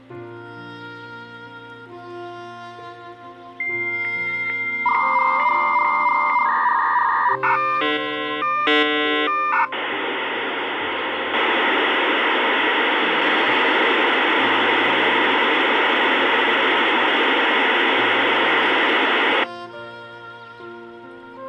Dial-up modem handshake (V.34 or later), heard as a whistle, warbles, then hiss.